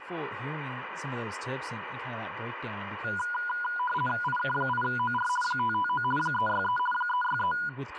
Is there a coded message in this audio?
Yes: RTTY (50 baud, 450 Hz shift) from 3.0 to 7.7 s, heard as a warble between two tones, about 1220 Hz centre, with radio static and speech in English. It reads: IK8OR 559 363 363